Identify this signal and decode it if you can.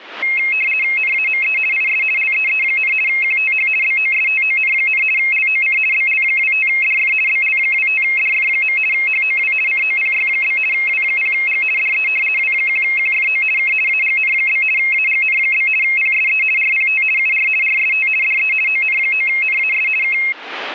RTTY (50 baud, 450 Hz shift), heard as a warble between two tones, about 2350 Hz centre. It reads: NAME IS LEE, QTH BOSTON, LOC BL25DF BL25DF. HOW COPY? W0G DE W1QFO K AGN? AGN? PSE RPT UR RST DE ON9NAS K